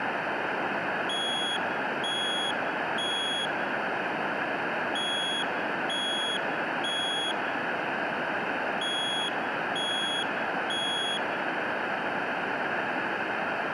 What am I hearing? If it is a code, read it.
Alarm pattern, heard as an alarm's beeps, played three times, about 3350 Hz, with room echo. Temporal three. Smoke or fire, evacuate.